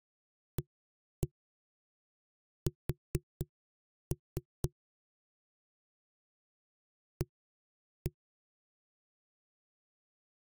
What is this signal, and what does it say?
Tap code, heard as knocks on a wall, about 4 knocks a second. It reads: AS A